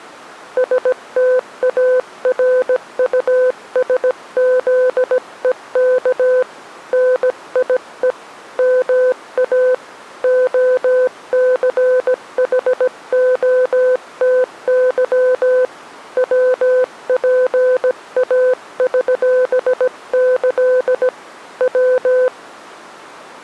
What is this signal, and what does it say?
Morse code (with Polish letters), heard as a keyed tone, hand-sent with a paddle, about 17 wpm, 510 Hz. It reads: STARUSZEK NIE MA OCHOTY WPAŚĆ W